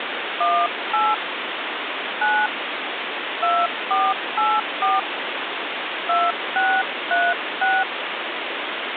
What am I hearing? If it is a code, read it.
DTMF, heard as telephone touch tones, dialled by hand, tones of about 230 ms, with phone line noise. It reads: 18 9 2484 2636